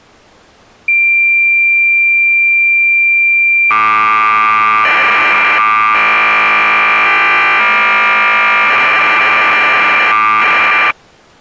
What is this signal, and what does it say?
Cassette data (Kansas City type), 1200 baud, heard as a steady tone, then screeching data.